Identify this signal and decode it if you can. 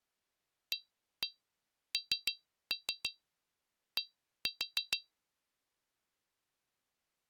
Tap code, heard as taps on glass, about 6 knocks a second. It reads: AND